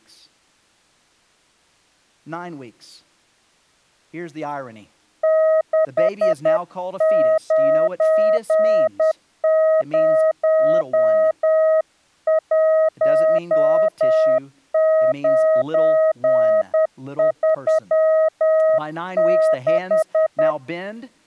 Morse code, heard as a keyed tone, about 10 wpm, 630 Hz, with speech in English. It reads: 6901936